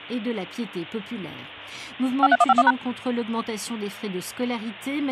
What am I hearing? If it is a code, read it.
DTMF, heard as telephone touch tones, dialled by machine, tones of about 40 ms. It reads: 53151#